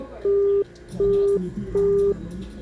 Telephone call progress tone (as in the UK, Australia and similar networks), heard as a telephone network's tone, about 400 Hz, 0.375 s on and 0.375 s off, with the noise of a restaurant. Busy tone.